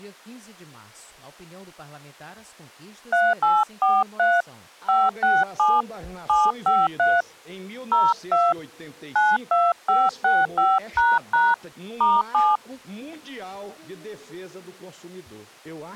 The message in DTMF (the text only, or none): 3843 567 753 02 92565## *7